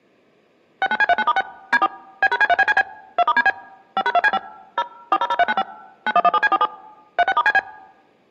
DTMF, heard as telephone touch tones, dialled by machine, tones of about 40 ms. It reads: 69C39*6 D4 B#C3BCB 2*DB 5#2C5 0 400395 9117C47 36*CB